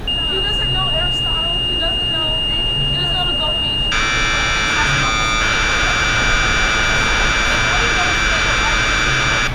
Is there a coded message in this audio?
Yes: Commodore tape loading (standard loader) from 0.1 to 9.5 s, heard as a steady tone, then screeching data, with room echo and street noise.